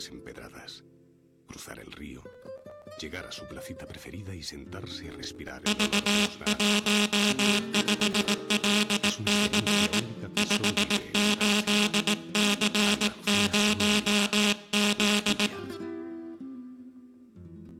Morse code, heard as a buzzer, hand-sent with a paddle, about 18 wpm, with room echo. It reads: V15LC 58C0Z